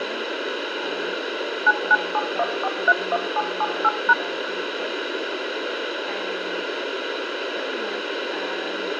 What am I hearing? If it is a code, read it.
DTMF, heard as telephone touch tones, dialled by machine, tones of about 40 ms, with radio hiss and room echo. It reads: 9971431778#